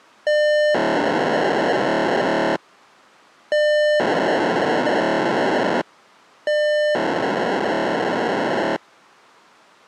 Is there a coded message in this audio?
Yes: POCSAG pager data (1200 baud) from 0.3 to 8.8 s, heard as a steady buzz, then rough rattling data.